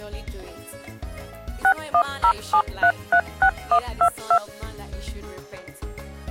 DTMF, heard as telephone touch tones, dialled by machine, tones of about 80 ms. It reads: 6107336122